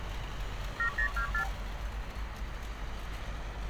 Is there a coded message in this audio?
Yes: multi-frequency trunk signalling (R2, with the far end's replies) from 0.8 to 1.5 s, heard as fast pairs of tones, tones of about 90 ms, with phone line noise and street noise. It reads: 7024